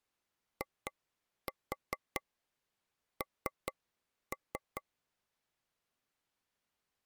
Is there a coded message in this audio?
Yes: tap code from 0.6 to 4.8 s, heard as taps on a table, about 4 knocks a second. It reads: IN